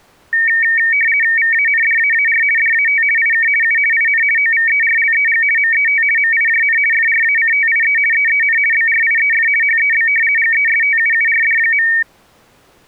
RTTY (50 baud, 450 Hz shift), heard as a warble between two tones, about 2050 Hz centre. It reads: VANDAAR DAT IK U IN OVERLEG MET MIJN FRACTIE EEN BRIEF HEB GESTUURD.